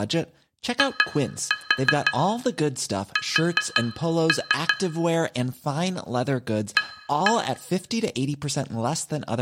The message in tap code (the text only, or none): IS A